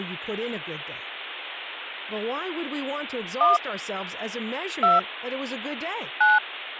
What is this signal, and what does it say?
DTMF, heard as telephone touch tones, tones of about 160 ms, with speech in English. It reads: 1 2 9